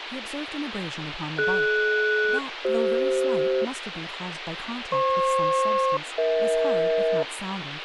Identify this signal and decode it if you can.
Aircraft SELCAL, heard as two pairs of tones, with radio hiss and speech in English. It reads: DS-CF FP-EH